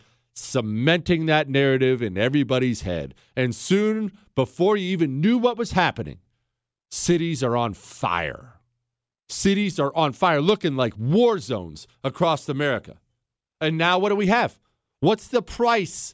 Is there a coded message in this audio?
No, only speech in English.